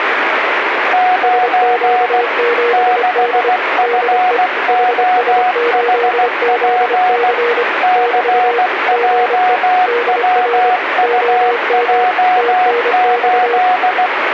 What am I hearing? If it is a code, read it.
Morse code, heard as two keyed tones, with radio static. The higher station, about 16 wpm, 730 Hz: 9 6FOHP CJWUJ8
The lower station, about 25 wpm, 480 Hz: SQ7D DE HS8ZC <BT> GE DR OM TNX